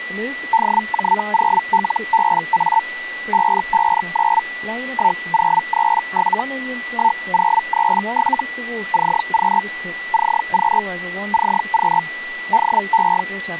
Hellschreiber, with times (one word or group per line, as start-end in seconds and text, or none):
0.5-2.8 DJ0LBA
3.3-4.4 559
4.9-6.4 1037
6.9-8.4 1037
8.9-9.6 CQ
10.1-10.8 CQ
11.3-12.0 CQ
12.5-13.2 DE